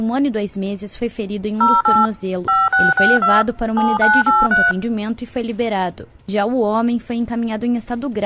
DTMF, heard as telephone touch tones, dialled by machine, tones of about 200 ms. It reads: 08 5662 7983